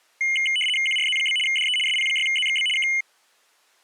RTTY (75 baud, 850 Hz shift), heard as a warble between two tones, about 2550 Hz centre. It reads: QRZ? DE SP6ZXB K